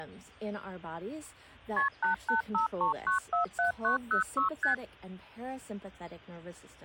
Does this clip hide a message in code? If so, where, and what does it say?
Yes: multi-frequency trunk signalling (R1, as on North American trunks) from 1.8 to 4.7 s, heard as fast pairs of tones, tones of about 120 ms. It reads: KP 8853947906 ST